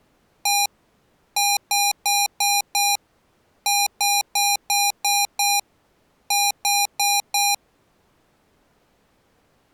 Beep code, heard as beeps from a small speaker, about 810 Hz. 1-5-6-4.